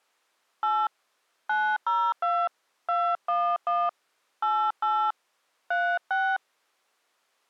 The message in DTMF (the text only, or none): 8 902 211 88 36